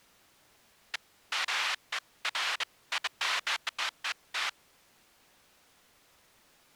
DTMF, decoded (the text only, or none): none